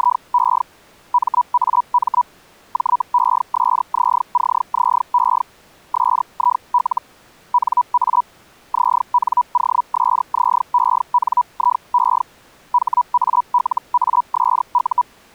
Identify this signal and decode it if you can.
Hellschreiber (Feld-Hell, 122.5 baud), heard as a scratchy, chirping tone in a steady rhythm, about 980 Hz. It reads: … MAM JESZCZE SIL NA ZNOSZENIE HALASU